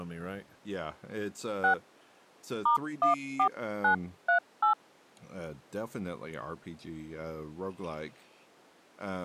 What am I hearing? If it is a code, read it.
DTMF, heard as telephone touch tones, dialled by hand, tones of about 120 ms, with speech in English. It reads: 6 *14938